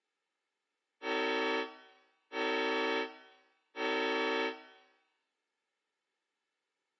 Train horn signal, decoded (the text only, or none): 3 short